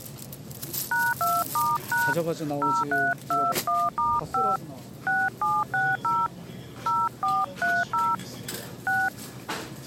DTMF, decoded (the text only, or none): #2*# 0321*5 6760 0430 6